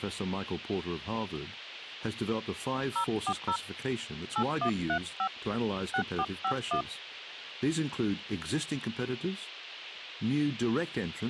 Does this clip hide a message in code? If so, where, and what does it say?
Yes: DTMF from 3.0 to 6.8 s, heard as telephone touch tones, dialled by hand, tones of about 80 ms, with speech in English. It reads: 040 8135 6451